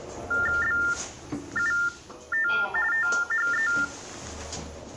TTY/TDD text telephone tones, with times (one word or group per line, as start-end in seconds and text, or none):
0.6-2.5 BUT
2.9-3.7 THE